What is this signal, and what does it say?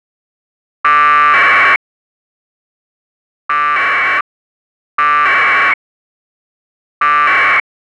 Packet radio (AX.25, as in APRS), 1200 baud, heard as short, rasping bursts.